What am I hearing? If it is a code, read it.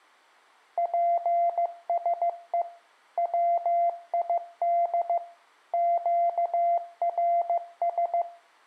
Morse code, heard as a keyed tone, machine-sent, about 15 wpm, 690 Hz, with room echo. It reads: PSE WID QRS